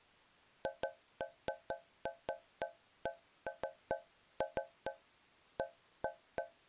Irregular taps on a metal pipe. There is no code.